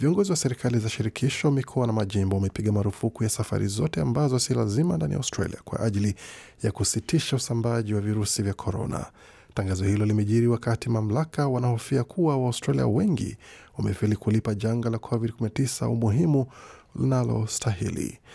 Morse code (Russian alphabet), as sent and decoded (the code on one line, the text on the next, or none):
none